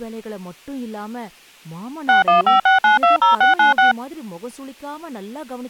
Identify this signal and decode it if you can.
DTMF, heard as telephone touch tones, dialled by machine, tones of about 140 ms, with speech in Tamil. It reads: 6156920696